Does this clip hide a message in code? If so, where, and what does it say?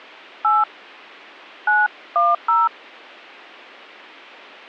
Yes: DTMF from 0.4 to 2.7 s, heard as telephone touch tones, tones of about 190 ms. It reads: 8 910